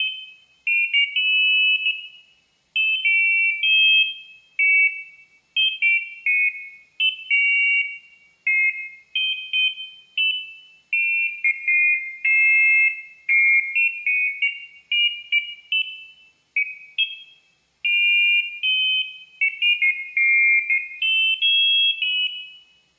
Pairs of high tones at irregular times, with room echo. There is no code.